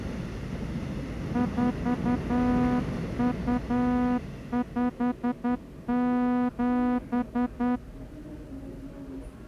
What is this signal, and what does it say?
Morse code (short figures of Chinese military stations), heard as a horn, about 10 wpm, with the noise of a subway station. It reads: 4257